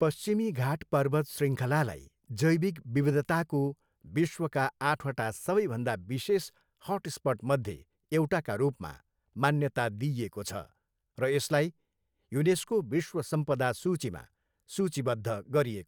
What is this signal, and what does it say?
Speech in Nepali. There is no code.